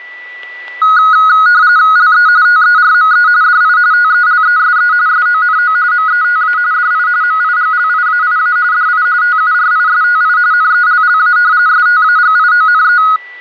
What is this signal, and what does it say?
RTTY (45.45 baud, 170 Hz shift), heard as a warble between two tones, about 1360 Hz centre, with static crashes and a steady whistle near 1970 Hz. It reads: LE TERME DI TELESE SONO META DI MIGLIAIA DI TURISTI NELLA STAGIONE